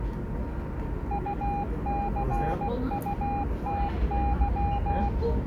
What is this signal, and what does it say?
Morse code (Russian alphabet), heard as a keyed tone, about 16 wpm, 810 Hz, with the noise of a subway station. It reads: УЦУТЫ